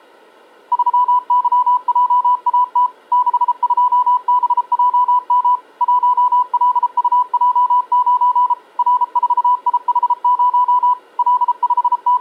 Morse code, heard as a keyed tone, machine-sent, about 33 wpm, 1000 Hz. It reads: 3YJAT 62BJM 1LUJ9 R4IH0 …